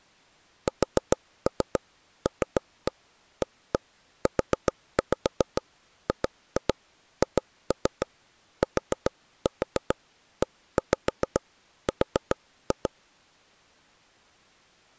Tap code, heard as taps on a table, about 7 knocks a second. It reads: SLAUGHTER